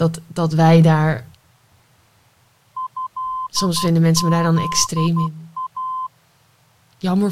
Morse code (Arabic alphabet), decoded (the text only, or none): هذا